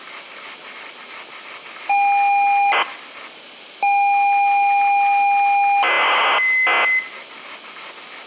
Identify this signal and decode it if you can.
ZX Spectrum tape loading, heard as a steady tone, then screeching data, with room echo and kitchen noise.